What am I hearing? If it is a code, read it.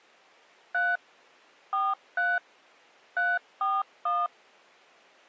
DTMF, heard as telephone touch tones, dialled by machine, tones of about 210 ms. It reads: 3 43 341